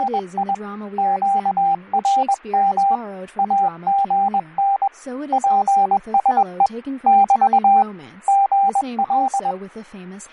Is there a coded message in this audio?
Yes: Morse code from 0.0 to 9.6 s, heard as a keyed tone, hand-sent with a paddle, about 21 wpm, 790 Hz, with fading and speech in English. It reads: … QRM AGN PSE <BT> GL